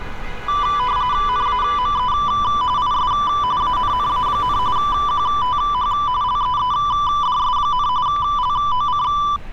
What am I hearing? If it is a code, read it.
RTTY (45.45 baud, 170 Hz shift), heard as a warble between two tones, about 1080 Hz centre, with static crashes and street noise. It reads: NAME IS ANNA, QTH LEEDS, LOC